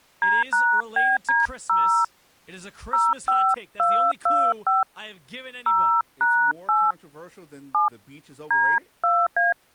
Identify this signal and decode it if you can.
DTMF, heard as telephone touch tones, dialled by hand, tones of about 240 ms, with speech in English. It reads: D#BD0 05225 0#8 7 D2A